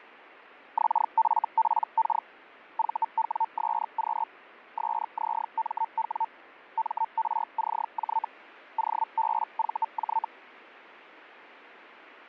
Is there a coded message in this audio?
Yes: Hellschreiber (Feld-Hell, 122.5 baud) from 0.8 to 10.3 s, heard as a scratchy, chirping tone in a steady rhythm, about 900 Hz, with radio static. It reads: XFPK VWSQ SZMW MRCJ OBVJ